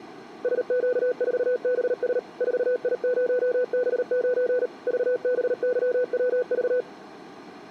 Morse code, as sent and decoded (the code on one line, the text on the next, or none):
... --.- ....- -... ... / ....- .. ----- -... ----. / ...- -... -.-- .-- ...-
SQ4BS 4I0B9 VBYWV